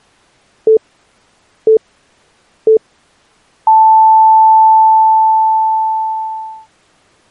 Radio time signal (three low pips and a long one an octave up, as on NHK), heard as pips.